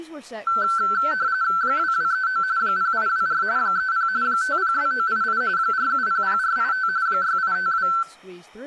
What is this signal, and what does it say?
RTTY (45.45 baud, 170 Hz shift), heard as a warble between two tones, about 1430 Hz centre, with room echo and speech in English. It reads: 2239 0824 30 502988 4700485 6852